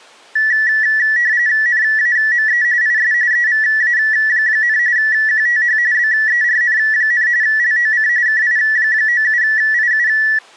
RTTY (45.45 baud, 170 Hz shift), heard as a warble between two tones, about 1850 Hz centre. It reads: NAME IS EVA, QTH BERN, LOC KI97IU